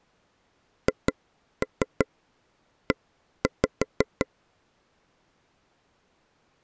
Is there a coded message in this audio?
Yes: tap code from 0.9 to 4.3 s, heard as taps on a table, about 5 knocks a second. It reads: HE